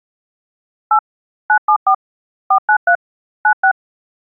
DTMF, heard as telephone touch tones, dialled by machine, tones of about 80 ms. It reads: 8 974 493 96